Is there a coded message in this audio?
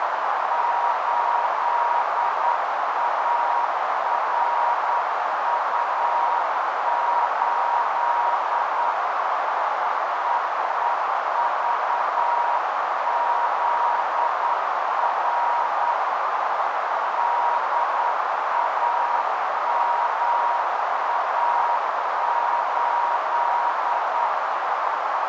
Yes: Morse code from 0.5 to 24.3 s, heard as a keyed tone, hand-sent with a paddle, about 9 wpm, 950 Hz, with heavy radio static and a narrow filter. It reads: 8ARU8 EEVZR DAMA8